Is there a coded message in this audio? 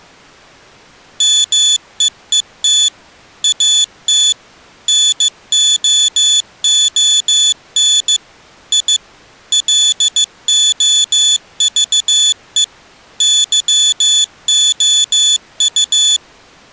Yes: Morse code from 1.1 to 16.2 s, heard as a high beeper, machine-sent, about 15 wpm, 3450 Hz. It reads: MEET AT NOON I LOVE YOU